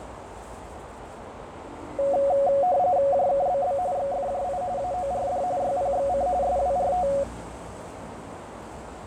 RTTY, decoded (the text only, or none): JKBB XFJI AORD YPXC SWRT